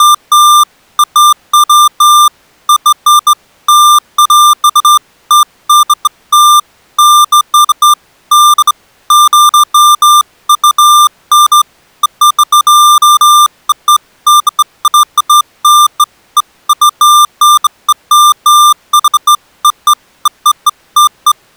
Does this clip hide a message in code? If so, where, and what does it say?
No, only beeps of irregular length.